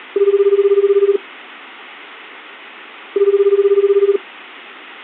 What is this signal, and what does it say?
Telephone call progress tone (Japanese plan), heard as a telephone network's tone, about 380, 400, 420 Hz, 1 s on and 2 s off. Ringback tone.